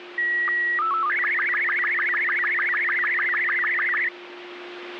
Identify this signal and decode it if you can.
SSTV (slow-scan television), Robot 36, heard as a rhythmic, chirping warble, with radio static and a steady whistle near 350 Hz.